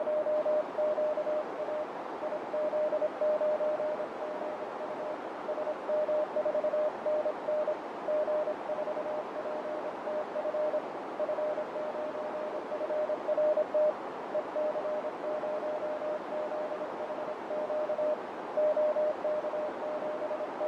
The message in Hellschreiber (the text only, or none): none